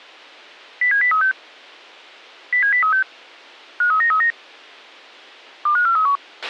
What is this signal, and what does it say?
Five-tone selective call (CCIR), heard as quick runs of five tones, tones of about 100 ms, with a squelch burst at the end. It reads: 07036 07036 53939 25431